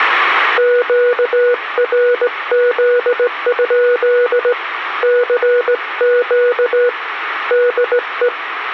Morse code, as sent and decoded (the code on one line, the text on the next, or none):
--.- .-. --.. ..--.. / -.-. --.- / -.. .
QRZ? CQ DE